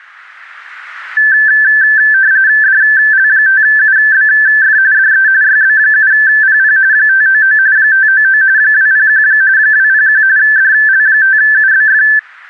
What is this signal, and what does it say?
RTTY (45.45 baud, 170 Hz shift), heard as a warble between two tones, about 1650 Hz centre. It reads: DL5UBF DE YB7PP 599 599 201 201 DL5UBF